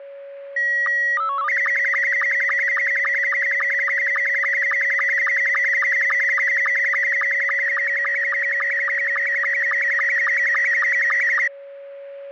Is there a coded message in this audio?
Yes: SSTV (slow-scan television), Scottie S2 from 0.6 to 11.5 s, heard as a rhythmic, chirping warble, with a steady whistle near 560 Hz.